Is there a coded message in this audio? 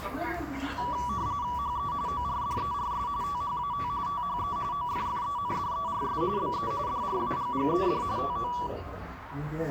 Yes: RTTY (45.45 baud, 170 Hz shift) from 0.8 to 8.7 s, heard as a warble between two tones, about 1060 Hz centre, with the noise of a crowd indoors. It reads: HE ORDERS THAT THE OFFENDERS BE DRAGGED TO